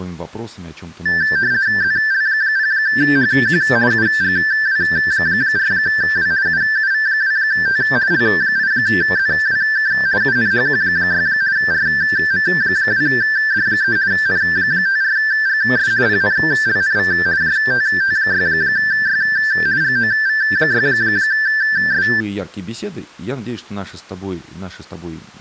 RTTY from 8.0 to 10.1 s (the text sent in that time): L8ZWK